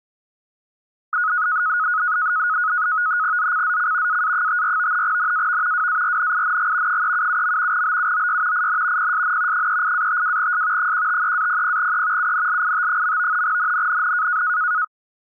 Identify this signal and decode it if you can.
NAVTEX (SITOR-B), 100 baud, 170 Hz shift, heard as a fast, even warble, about 1360 Hz centre. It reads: ZCZC AA54 NAV WARNING 377. BUOY IN PSN 38-52S 153-00E UNLIT. NNNN